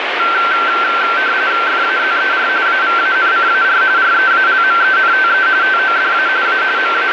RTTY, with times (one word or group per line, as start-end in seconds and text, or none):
1.7-2.5 FAZER
2.7-3.8 AVANCAR
4.0-5.5 REALMENTE
5.6-6.3 TODA
6.5-6.6 A
6.8-7.1 …